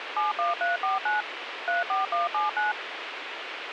DTMF, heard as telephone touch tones, dialled by machine, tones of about 150 ms, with radio hiss. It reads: 71349 34179